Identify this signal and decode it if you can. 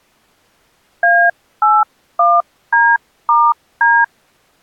DTMF, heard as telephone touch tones, dialled by hand, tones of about 230 ms. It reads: A81D*D